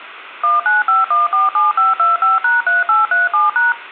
DTMF, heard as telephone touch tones, dialled by machine, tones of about 160 ms, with phone line noise. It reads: 195147525#3837#